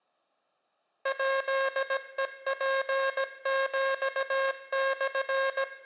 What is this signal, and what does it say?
Morse code (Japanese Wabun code), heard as a buzzer, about 17 wpm, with room echo. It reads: ヱヘツヒモ